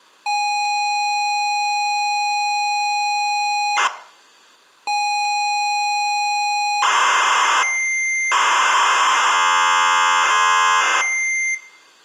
ZX Spectrum tape loading, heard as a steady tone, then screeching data, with room echo.